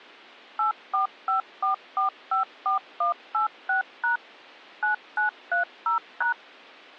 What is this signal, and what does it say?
DTMF, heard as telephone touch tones, dialled by machine, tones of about 120 ms. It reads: 8454454186# 9930#